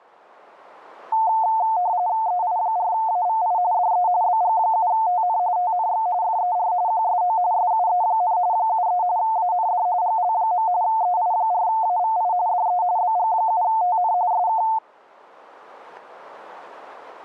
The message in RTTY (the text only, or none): EI4AVI DE BG7TN TNX FER QSO SUE, 73 AND GL. EI4AVI DE BG7TN SK